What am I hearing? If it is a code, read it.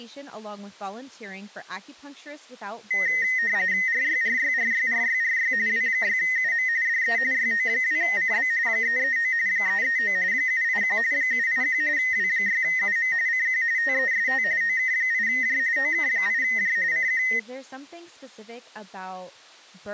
RTTY (45.45 baud, 170 Hz shift), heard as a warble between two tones, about 1950 Hz centre, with speech in English. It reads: RYRYRYRYRY W6UM DE YO2CB 339 339 781 781 W6UM CQ TEST OK8J OK8J CQ